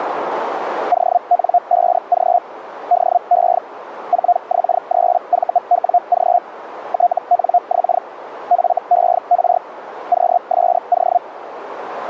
Hellschreiber (Feld-Hell, 122.5 baud), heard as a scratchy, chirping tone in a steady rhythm, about 710 Hz, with radio static. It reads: ON5G DE 4X3VWG TNX FER QSO